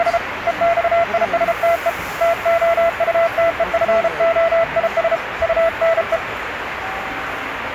Morse code, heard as a keyed tone, hand-sent with a paddle, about 33 wpm, 670 Hz, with radio static and the noise of a restaurant. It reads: … EXISTE TOUTEFOIS UNE